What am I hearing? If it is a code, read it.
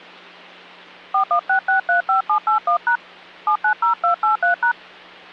DTMF, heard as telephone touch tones, dialled by hand, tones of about 110 ms, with hum. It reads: 416635781# 790283#